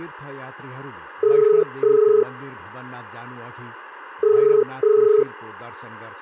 Telephone call progress tone (as in the UK, Ireland, Australia and similar networks), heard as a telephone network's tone, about 430 Hz, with hum and speech in Nepali. Ringback tone.